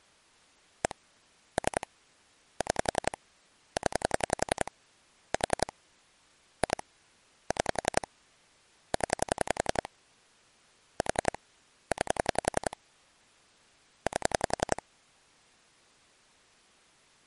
Pulse dialling, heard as clicks on a phone line, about 11 pulses a second. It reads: 1 3 6 0 4 2 6 0 4 9 8